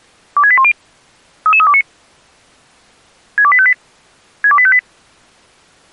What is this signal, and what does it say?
Five-tone selective call (ZVEI), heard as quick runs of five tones, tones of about 70 ms. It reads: 26810 33329 62858 62858